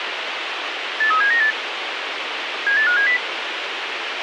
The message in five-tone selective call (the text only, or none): 83798 78570